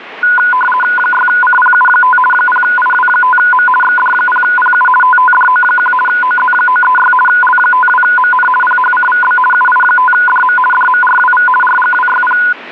RTTY (50 baud, 450 Hz shift), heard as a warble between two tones, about 1230 Hz centre. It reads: 6CPU5 0IW5M XD0PU TTDO1 OZ936 L52MN PHCVB UI5DM DMRWV RGWYP